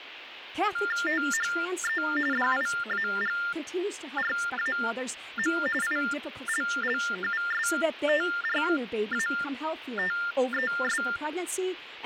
TTY/TDD text telephone tones (45.45 baud Baudot), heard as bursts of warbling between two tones, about 400 Hz shift, 1600 Hz centre, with phone line noise and speech in English. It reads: THE DIAGRAM ILLUSTRATES